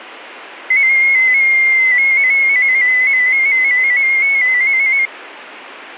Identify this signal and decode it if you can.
Multi-tone FSK (Olivia or MFSK type), about 250 Hz wide, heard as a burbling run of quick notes, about 15.625 baud.